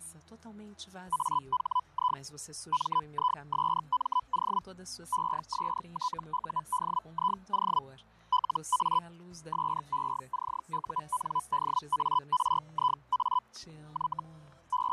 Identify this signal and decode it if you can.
Hellschreiber (Feld-Hell, 122.5 baud), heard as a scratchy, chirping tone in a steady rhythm, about 1000 Hz, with fading and static crashes. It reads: AHI MISMO ESTUDIO LA SECUNDARIA Y …